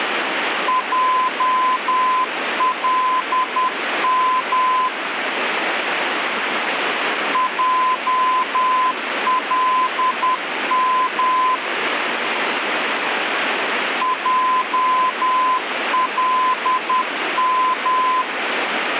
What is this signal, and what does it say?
Morse code, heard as a keyed tone, machine-sent, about 10 wpm, 1020 Hz, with radio static. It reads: JLM JLM JLM